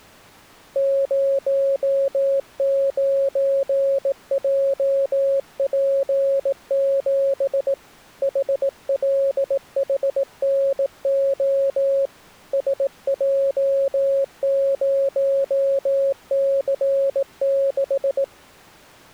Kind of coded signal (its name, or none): Morse code